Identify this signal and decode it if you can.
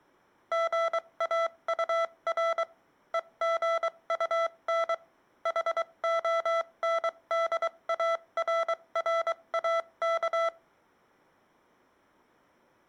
Morse code, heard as electronic beeps, machine-sent, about 23 wpm, spaced as for 20 wpm, 670 Hz. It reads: GAUR EGUN HONDARRAK